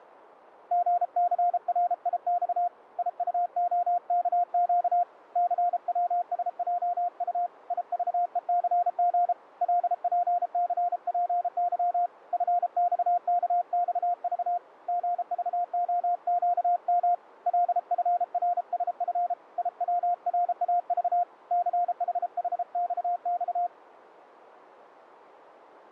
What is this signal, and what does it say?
Morse code, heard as a keyed tone, hand-sent with a paddle, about 33 wpm, 700 Hz. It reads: GCRIX IUOKQ CWSJU IVECG LPCPY FXKXV GVOQM LFRSF IWRAV CHHXX